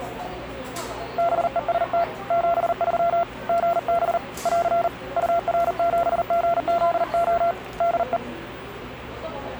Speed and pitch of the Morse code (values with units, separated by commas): 39 wpm, 680 Hz